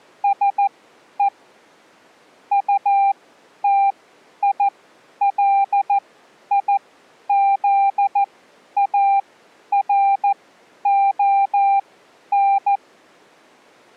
Morse code, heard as a keyed tone, machine-sent, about 14 wpm, spaced as for 10 wpm, 790 Hz. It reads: SE UTILIZARON